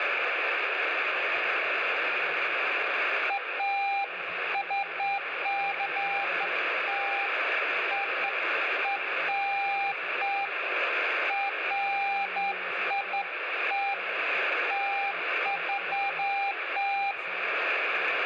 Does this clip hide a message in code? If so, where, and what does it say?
No, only beeps of irregular length, with radio static.